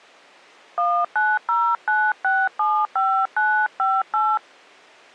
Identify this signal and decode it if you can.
DTMF, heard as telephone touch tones, dialled by hand, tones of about 260 ms. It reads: 1909675958